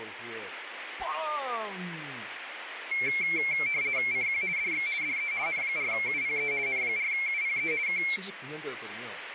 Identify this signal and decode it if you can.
RTTY (50 baud, 170 Hz shift), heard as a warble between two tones, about 2250 Hz centre, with radio static and speech in Korean. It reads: CQ DX DE N4UPE N4UPE K